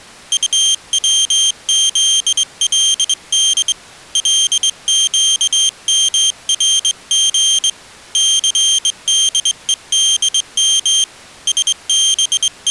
Morse code, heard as a high beeper, hand-sent with a straight key, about 22 wpm, 3150 Hz. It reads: UWZLD LQMRG CDEDM …